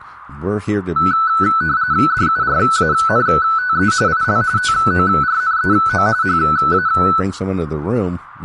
RTTY (45.45 baud, 170 Hz shift), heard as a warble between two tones, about 1400 Hz centre, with speech in English. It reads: DURANTE IL TORNEO HA